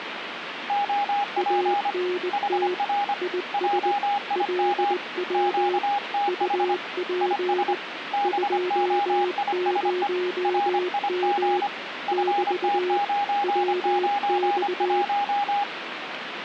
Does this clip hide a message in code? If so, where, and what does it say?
Yes: Morse code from 0.6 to 15.7 s, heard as two keyed tones, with radio static. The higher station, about 25 wpm, 810 Hz: OP HR JIM QTH IS BOISE RIG FT991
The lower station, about 20 wpm, 360 Hz: ANT IS LW UP 20M <BT> WX